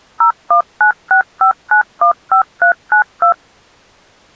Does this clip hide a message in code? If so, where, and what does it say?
Yes: DTMF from 0.2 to 3.3 s, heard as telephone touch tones, dialled by machine, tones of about 100 ms. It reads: 01965915392